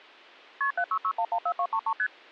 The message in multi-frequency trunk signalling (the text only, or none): KP 766114233 ST